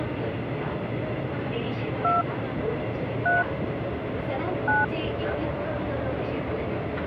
DTMF, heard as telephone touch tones, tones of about 210 ms, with the noise inside a subway train. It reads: 2 3 9